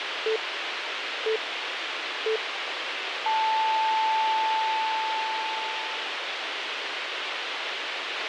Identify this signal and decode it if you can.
Radio time signal (three low pips and a long one an octave up, as on NHK), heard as pips, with radio hiss and a squelch burst at the end.